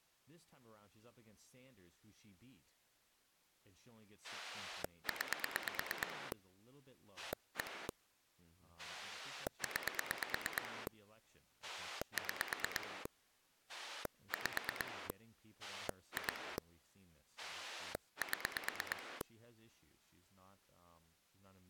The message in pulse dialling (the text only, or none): 9 1 9 6 5 2 7